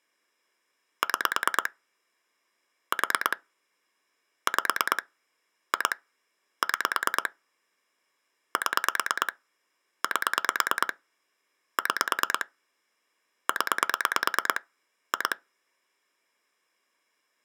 Pulse dialling, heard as clicks on a phone line, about 9 pulses a second. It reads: 6 4 5 2 6 7 8 6 0 2